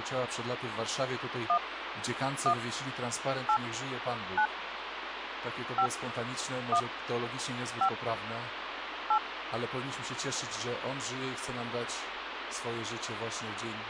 DTMF, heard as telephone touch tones, dialled by hand, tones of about 80 ms, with phone line noise. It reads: 1 1 8 9 5 1 5 8